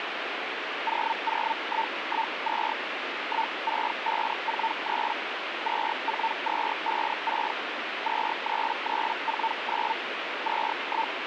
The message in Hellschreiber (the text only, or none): 00112 16543 24256 23349 …